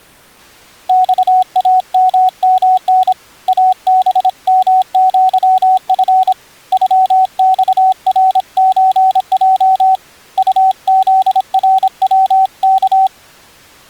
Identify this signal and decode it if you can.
Morse code (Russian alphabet), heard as a keyed tone, hand-sent with a paddle, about 26 wpm, 750 Hz. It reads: ЬАММН АБМЪФ ЮЬРЧЙ УЗРВК